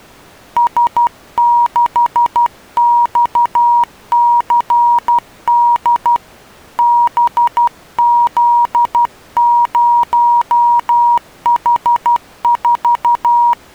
Morse code, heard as a keyed tone, hand-sent with a paddle, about 12 wpm, 950 Hz. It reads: S6XCD BZ0H4